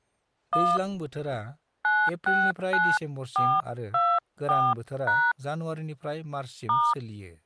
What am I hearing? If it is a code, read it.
DTMF, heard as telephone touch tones, dialled by hand, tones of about 240 ms, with speech in Bodo. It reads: 1 969424# *